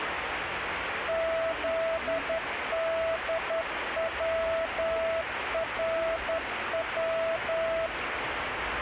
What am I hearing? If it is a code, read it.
Morse code, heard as a keyed tone, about 11 wpm, 660 Hz, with radio static and street noise. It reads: ZDWRW